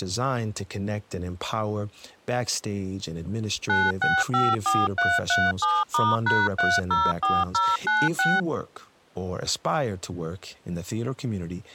DTMF, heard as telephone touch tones, dialled by machine, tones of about 210 ms, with speech in English. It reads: 9654337*#304096